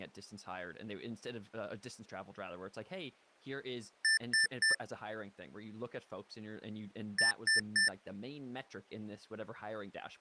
Beep code, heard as beeps from a small speaker, played twice, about 1800 Hz, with speech in English. 3 short. In AMI BIOS tables: failure in the first 64 KB of memory; in Dell tables: chipset error.